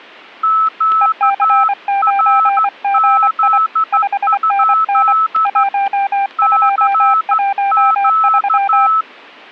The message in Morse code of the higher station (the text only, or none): QRZ? CQ